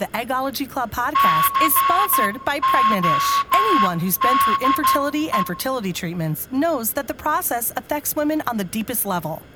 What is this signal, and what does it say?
Morse code, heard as a whistle, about 12 wpm, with room echo and speech in English. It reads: CODE